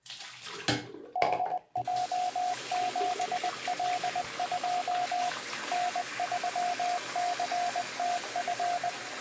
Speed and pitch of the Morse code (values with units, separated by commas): 20 wpm, 720 Hz